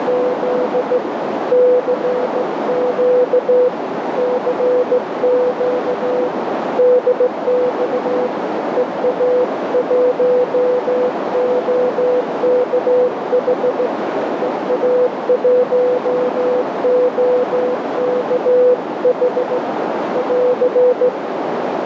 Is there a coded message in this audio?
Yes: Morse code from 0.0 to 21.1 s, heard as a keyed tone, hand-sent with a straight key, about 16 wpm, 500 Hz, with heavy radio static and a narrow filter. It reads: … CQ CQ DX EA1OKH EA1OKH <AR>